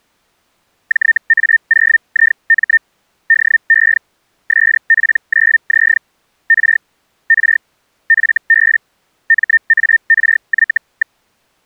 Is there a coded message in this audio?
Yes: Hellschreiber (Feld-Hell, 122.5 baud) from 0.9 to 11.2 s, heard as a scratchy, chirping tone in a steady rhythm, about 1800 Hz. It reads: JA0IM DE SP9Z R R FB MARY.